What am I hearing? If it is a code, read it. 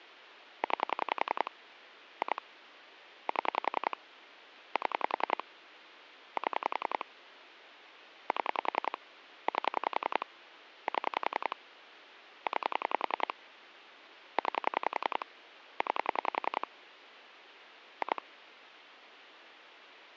Pulse dialling, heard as clicks on a phone line, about 10 pulses a second, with phone line noise. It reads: 9 2 7 7 7 7 8 7 9 9 9 2